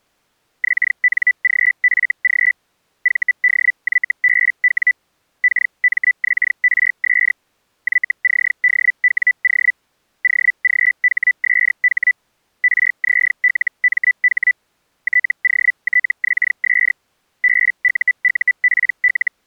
Hellschreiber (Feld-Hell, 122.5 baud), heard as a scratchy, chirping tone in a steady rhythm, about 2000 Hz. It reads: XNGFG VDYBW KMXRS YCDWO OGHSH RZLMH TOTXS BUUPL